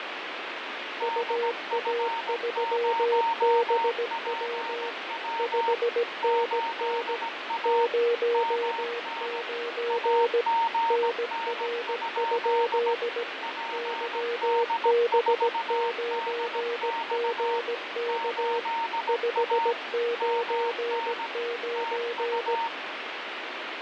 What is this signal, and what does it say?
Morse code, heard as two keyed tones, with heavy radio static and fading. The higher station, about 17 wpm, 920 Hz: DF0PW 8A MN AGN? PD4DX 8A MN TU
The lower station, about 17 wpm, 470 Hz: UA3BW 5NN 09 NR? YB9GK 599